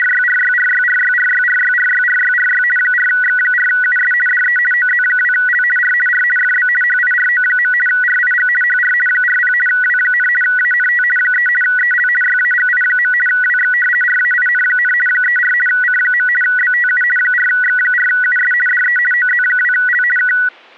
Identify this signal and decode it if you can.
RTTY (50 baud, 450 Hz shift), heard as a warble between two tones, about 1700 Hz centre. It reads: … 4X4US DE OZ2L R R FB HIRO. RIG HR 40 W, ANT 3 EL YAGI. WX RAIN, 34 C. BTU 4X4US DE OZ2L K